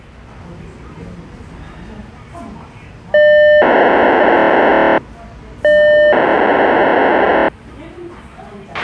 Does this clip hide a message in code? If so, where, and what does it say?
Yes: POCSAG pager data (1200 baud) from 3.1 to 7.5 s, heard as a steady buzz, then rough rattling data, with a squelch burst at the end and the noise of a restaurant.